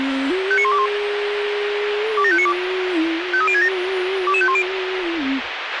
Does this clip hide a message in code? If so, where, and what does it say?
Yes: five-tone selective call (ZVEI) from 0.5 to 4.6 s, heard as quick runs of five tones, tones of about 70 ms, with radio hiss and a squelch burst at the end. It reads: 59121 27592 53067 22510